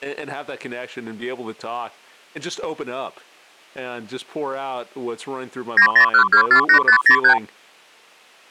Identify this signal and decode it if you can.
Multi-frequency trunk signalling (R2, with the far end's replies), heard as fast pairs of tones, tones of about 90 ms, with speech in English. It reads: 901248503